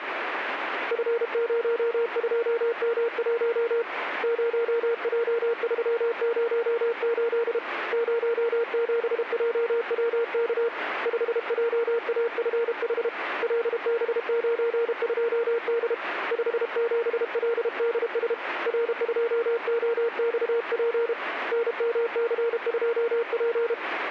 Morse code, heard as a keyed tone, hand-sent with a paddle, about 32 wpm, 470 Hz, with radio static. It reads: F02M1 0J308 07JWK 5JAFH LB92D 57LDS R2OXP NMC2P